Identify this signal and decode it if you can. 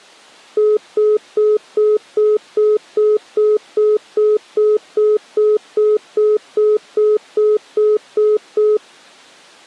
Telephone call progress tone (single-tone plan, as in most of Europe), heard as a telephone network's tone, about 420 Hz, 0.2 s on and 0.2 s off. Congestion tone.